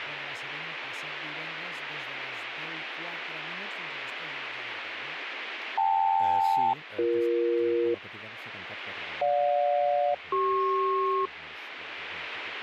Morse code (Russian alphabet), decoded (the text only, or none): none